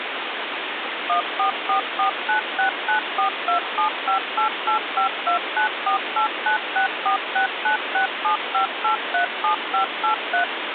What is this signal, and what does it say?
DTMF, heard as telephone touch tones, dialled by machine, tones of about 110 ms, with phone line noise. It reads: 14449694275885294896469675837583